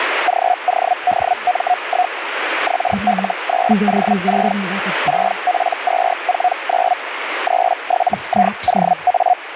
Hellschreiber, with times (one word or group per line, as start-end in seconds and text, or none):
0.3-2.1 GODM1
2.7-4.5 XL9O6
5.1-6.9 6P249
7.5-9.3 37IOA